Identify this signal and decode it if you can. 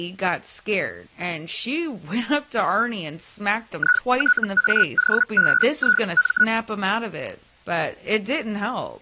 Hellschreiber (Feld-Hell, 122.5 baud), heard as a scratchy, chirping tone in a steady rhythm, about 1470 Hz, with speech in English. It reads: ITAOBIM